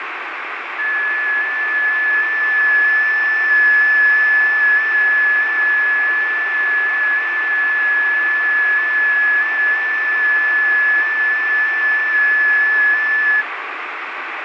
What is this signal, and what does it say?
FT8 (one signal), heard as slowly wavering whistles, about 6.25 baud, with radio static.